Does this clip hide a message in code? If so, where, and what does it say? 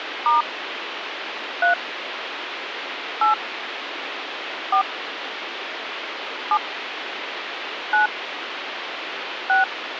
Yes: DTMF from 0.3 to 9.6 s, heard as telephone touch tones, dialled by hand, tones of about 100 ms, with phone line noise. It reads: * 3 8 4 7 9 6